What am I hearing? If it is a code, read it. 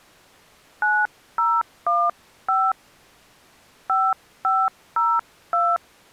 DTMF, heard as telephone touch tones, dialled by hand, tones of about 230 ms. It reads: 9015 5502